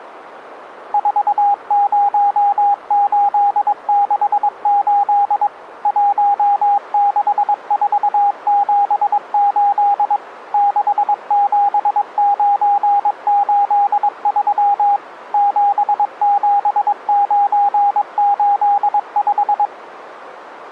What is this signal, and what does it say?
Morse code, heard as a keyed tone, machine-sent, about 22 wpm, 810 Hz. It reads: 40868 16478 67983 77985